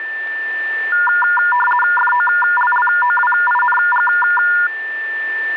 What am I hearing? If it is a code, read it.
RTTY (50 baud, 450 Hz shift), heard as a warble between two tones, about 1200 Hz centre, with a steady whistle near 1780 Hz. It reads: FOLLOWING